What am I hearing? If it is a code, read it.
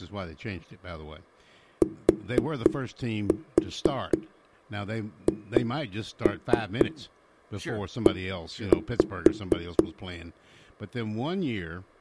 Tap code, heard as knocks on a wall, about 4 knocks a second, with speech in English. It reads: THE